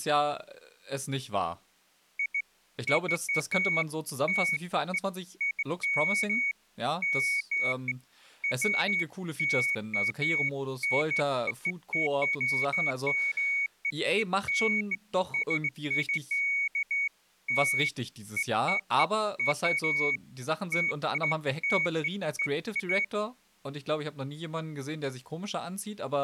Beeps of irregular length, with speech in German. There is no code.